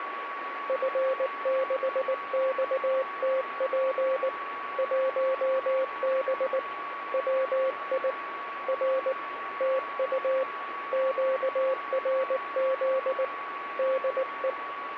Morse code, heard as a keyed tone, hand-sent with a paddle, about 19 wpm, 530 Hz, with radio static and a steady whistle near 1130 Hz. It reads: F6XTP 1B WI R TU QRZ DE